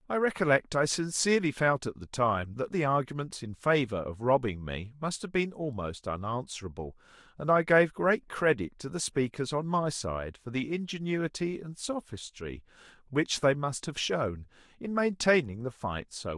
Speech in English. There is no code.